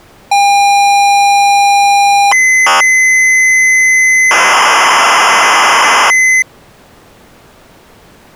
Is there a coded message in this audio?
Yes: ZX Spectrum tape loading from 0.3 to 6.4 s, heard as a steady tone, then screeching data.